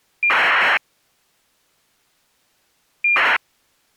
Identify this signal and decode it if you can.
ACARS aircraft data, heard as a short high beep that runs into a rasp, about 2400 baud.